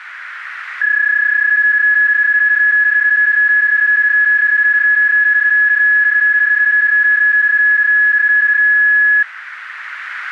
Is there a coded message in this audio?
Yes: PSK31 (31.25 baud) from 0.8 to 9.2 s, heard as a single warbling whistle, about 1700 Hz, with radio static.